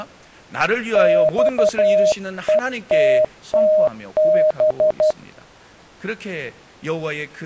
Morse code, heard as a keyed tone, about 12 wpm, 620 Hz, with speech in Korean. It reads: XETTB